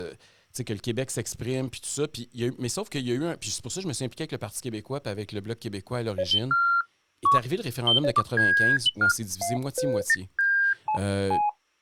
Electronic bleeps of random pitch and length, with speech in French. There is no code.